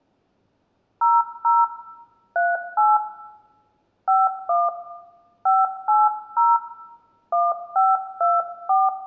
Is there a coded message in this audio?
Yes: DTMF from 1.0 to 8.9 s, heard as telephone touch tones, dialled by hand, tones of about 200 ms, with room echo. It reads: 00 38 51 580 1524